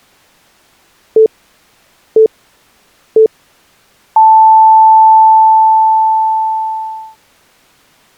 Radio time signal (three low pips and a long one an octave up, as on NHK), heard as pips.